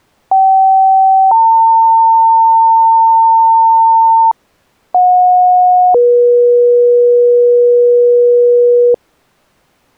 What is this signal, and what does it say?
Two-tone page, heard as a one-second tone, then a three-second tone, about 770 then 900 Hz, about 730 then 480 Hz.